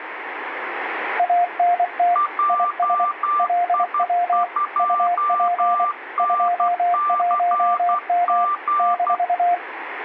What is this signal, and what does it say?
Morse code, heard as two keyed tones, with radio static. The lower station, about 24 wpm, 700 Hz: ANT IS LW UP 21M -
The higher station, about 12 wpm, 1180 Hz: JI2NCG